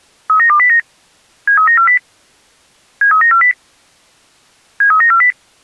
Five-tone selective call (CCIR), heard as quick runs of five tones, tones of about 100 ms. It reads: 39209 73940 73940 73940